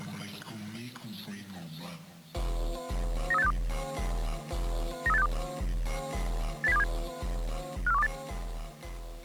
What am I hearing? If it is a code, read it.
Five-tone selective call (EEA), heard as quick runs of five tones, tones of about 40 ms. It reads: 93862 93862 80727 54128